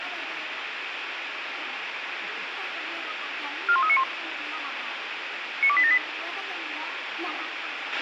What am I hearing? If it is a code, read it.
Five-tone selective call (ZVEI), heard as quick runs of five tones, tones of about 70 ms, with radio hiss and a squelch burst at the end. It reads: 41391 92878